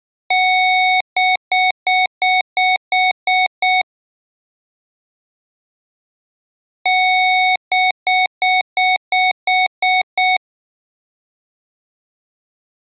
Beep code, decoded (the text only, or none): 1 long, 8 short